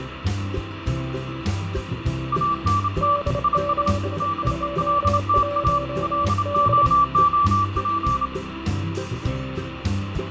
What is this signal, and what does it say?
Morse code, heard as two keyed tones, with radio static and fading. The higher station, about 28 wpm, 1160 Hz: ANT IS DELTA LOOP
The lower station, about 27 wpm, 580 Hz: D721D